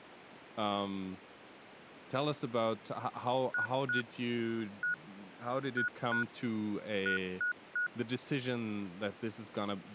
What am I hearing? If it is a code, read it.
Beep code, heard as beeps from a small speaker, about 1460 Hz, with speech in English. 2-1-2-3. In Phoenix BIOS tables: ROM copyright notice check failure.